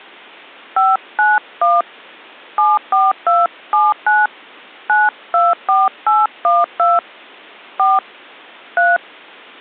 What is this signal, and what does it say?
DTMF, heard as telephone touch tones, dialled by hand, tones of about 190 ms. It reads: 591 74279 924812 4 3